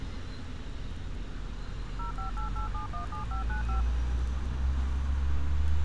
DTMF, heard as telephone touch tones, dialled by machine, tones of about 120 ms, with street noise. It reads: 0588717595